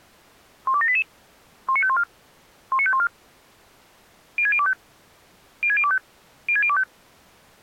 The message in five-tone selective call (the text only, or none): 12788 19514 19514 06025 06025 06025